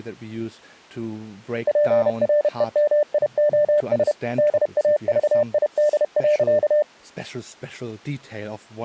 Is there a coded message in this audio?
Yes: Morse code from 1.6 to 6.9 s, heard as a keyed tone, machine-sent, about 31 wpm, 600 Hz, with speech in Danish. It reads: PREMIOS DAVID.